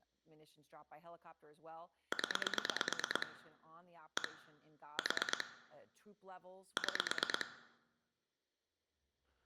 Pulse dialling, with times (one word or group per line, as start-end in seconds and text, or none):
2.1-3.3 0
4.2-4.3 1
5.0-5.4 4
6.8-7.5 6